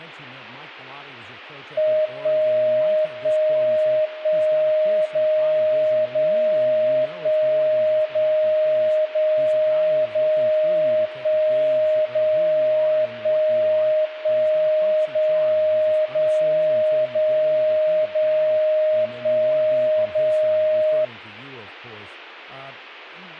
Radio time signal (DCF77), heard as a tone whose level steps once a second, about 620 Hz, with speech in English. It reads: 1 1 1 0 0 1 0 0 0 1 0 1 1 0 0 0 0 1 0